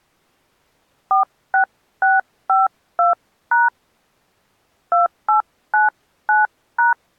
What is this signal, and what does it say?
DTMF, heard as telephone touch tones, dialled by hand, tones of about 140 ms. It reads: 46652# 2899#